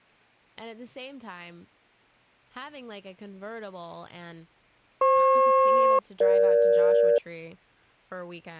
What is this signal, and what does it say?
Aircraft SELCAL, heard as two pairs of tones, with speech in English. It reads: FP-EG